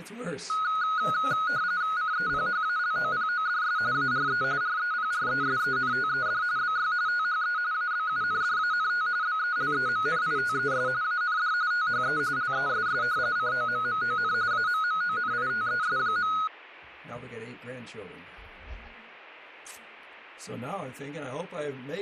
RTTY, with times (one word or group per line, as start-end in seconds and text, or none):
2.0-3.8 CEPHALOPODS
3.9-4.4 ARE
4.6-6.4 REPRESENTED
6.6-6.9 BY
7.1-7.6 THE
7.7-9.1 ABUNDANT
9.2-10.9 BELEMNITES
11.0-11.5 AND
11.7-12.2 THE
12.4-13.0 LESS
13.4-14.3 COMMON
14.5-16.3 AMMONITES.